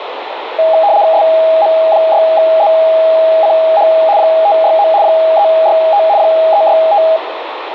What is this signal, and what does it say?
RTTY (75 baud, 170 Hz shift), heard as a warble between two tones, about 730 Hz centre, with radio static and room echo. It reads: SM6ZCH 569 365 365